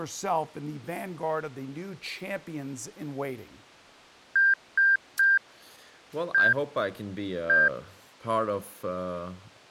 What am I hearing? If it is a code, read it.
Beep code, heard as beeps, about 1600 Hz, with speech in English. 3-1-1. In Phoenix BIOS tables: DMA register failure.